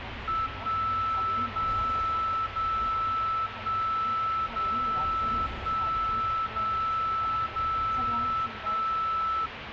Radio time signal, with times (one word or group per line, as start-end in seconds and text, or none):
0.5-1.5 1
1.5-2.5 0
2.5-3.5 0
3.5-4.5 1
4.5-5.5 0
5.5-6.5 1
6.5-7.5 0
7.5-8.5 0
8.5-9.5 1